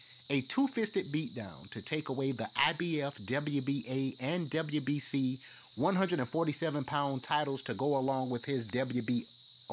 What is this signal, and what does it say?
A steady tone, with radio static, a narrow filter and speech in English. There is no code.